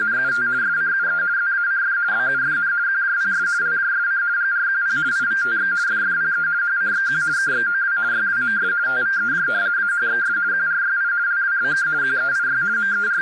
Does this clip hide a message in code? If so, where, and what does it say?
Yes: RTTY (50 baud, 170 Hz shift) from 0.0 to 13.2 s, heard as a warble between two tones, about 1500 Hz centre, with radio static and speech in English. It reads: … SCUE ZACF BUFN QJPS LJSC GRQP IVTX FFPE HCXQ KXOW YWMS TVEJ AHXS QRYI LWBK QEIY …